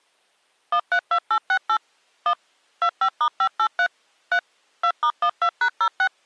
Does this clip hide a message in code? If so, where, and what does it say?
Yes: DTMF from 0.7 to 6.1 s, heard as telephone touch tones, dialled by machine, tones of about 70 ms. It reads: 132868 1 25*583 3 2*12#06